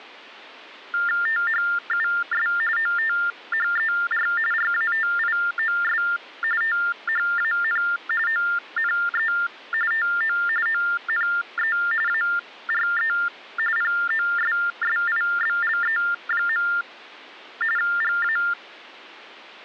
TTY/TDD text telephone tones (45.45 baud Baudot), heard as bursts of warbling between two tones, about 400 Hz shift, 1600 Hz centre. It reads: THUS OTHER RATIOS THAN ONE TO ONE ARE POSSIBLE. GA